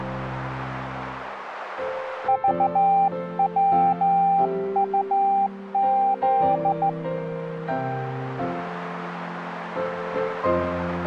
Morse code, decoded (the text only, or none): VWUZ